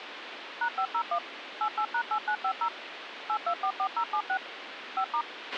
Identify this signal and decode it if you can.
DTMF, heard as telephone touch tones, dialled by machine, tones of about 80 ms, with radio hiss and a squelch burst at the end. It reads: #501 88#8950 8244076 5*